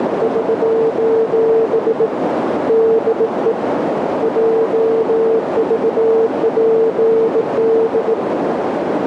Morse code, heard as a keyed tone, hand-sent with a bug key, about 18 wpm, 450 Hz, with heavy radio static and a narrow filter. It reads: <SOS> DE JVPD